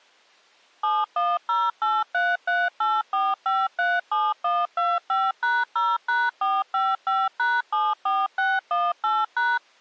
DTMF, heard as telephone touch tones, dialled by machine, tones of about 210 ms. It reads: 71083384537125#0#455#74618#